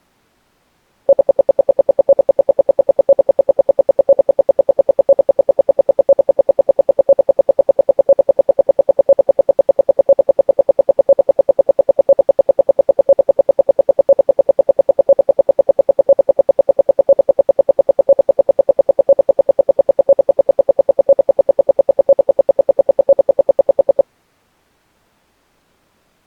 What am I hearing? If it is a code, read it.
Radio time signal (RWM, Moscow), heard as ten pulses a second.